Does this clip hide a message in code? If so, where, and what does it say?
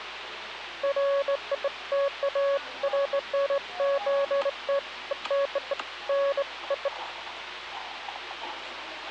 No, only beeps of irregular length, with the noise of a cafe.